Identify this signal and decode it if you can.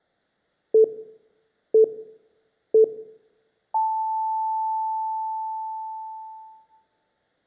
Radio time signal (three low pips and a long one an octave up, as on NHK), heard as pips, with room echo.